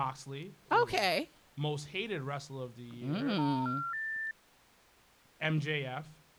Telephone call progress tone (North American plan), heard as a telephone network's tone, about 910, 1370, 1800 Hz, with speech in English. Special information tone.